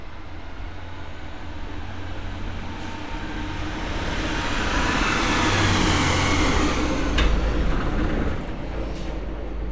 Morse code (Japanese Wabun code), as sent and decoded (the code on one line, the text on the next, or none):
none